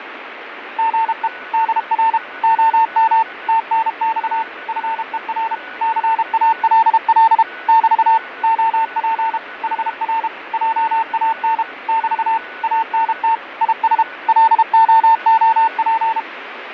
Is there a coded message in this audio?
Yes: Morse code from 0.7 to 16.3 s, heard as a keyed tone, machine-sent, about 32 wpm, 900 Hz, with radio static, fading and a weaker station near 1480 Hz. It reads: GE DR OM TNX FER CALL <BT> OP HR JAN <BT> ANT IS LOOP